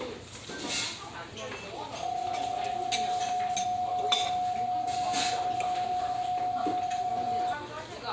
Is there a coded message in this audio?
Yes: PSK31 (31.25 baud) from 2.0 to 7.5 s, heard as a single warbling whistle, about 730 Hz, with the noise of a restaurant.